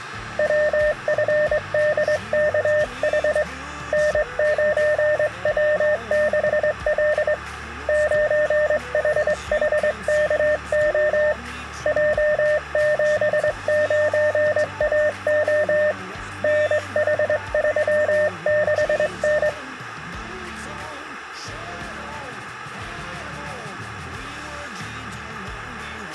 Morse code, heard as a keyed tone, hand-sent with a straight key, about 22 wpm, 600 Hz. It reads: WFDKH N9W6L 9HHKO J79AO NH36N